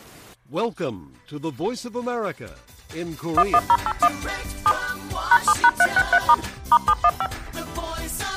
DTMF, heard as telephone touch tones, dialled by machine, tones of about 60 ms. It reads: 11081 7 #7#363* *715